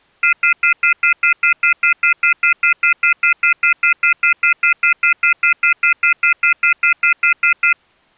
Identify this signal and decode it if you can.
Telephone call progress tone (North American plan), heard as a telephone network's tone, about 1400, 2050, 2450, 2600 Hz, 0.1 s on and 0.1 s off. Off-hook warning tone.